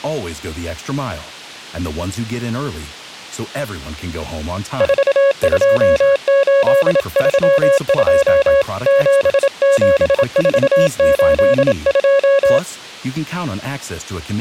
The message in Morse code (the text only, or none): 42832 77482